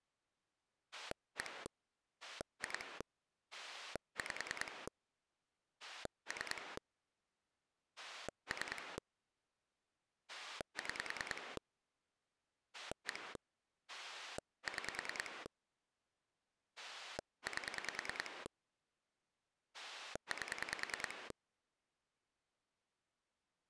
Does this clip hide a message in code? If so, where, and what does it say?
Yes: pulse dialling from 0.9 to 21.3 s, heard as a rotary dial, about 10 pulses a second. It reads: 1 2 5 3 3 6 1 6 8 8